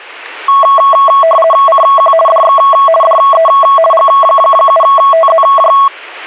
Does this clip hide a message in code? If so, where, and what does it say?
Yes: RTTY (50 baud, 450 Hz shift) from 0.5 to 5.9 s, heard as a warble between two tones, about 880 Hz centre. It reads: CQ DX DE G7TZJ